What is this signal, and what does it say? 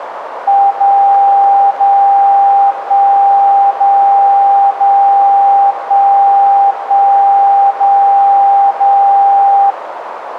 Radio time signal (DCF77), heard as a tone whose level steps once a second, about 800 Hz, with radio static and a narrow filter. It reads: 0 0 1 0 0 1 1 0 0